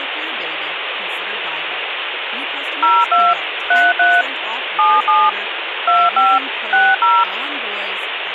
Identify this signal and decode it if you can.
DTMF, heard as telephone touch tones, dialled by machine, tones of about 220 ms, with phone line noise and speech in English. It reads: 02 33 77 25 60